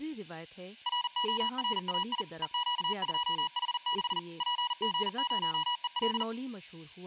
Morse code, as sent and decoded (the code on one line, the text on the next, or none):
.-. --- .-. .- .. / . --.- ..--- .... -.... / .--. --. ----- . .-..
RORAI EQ2H6 PG0EL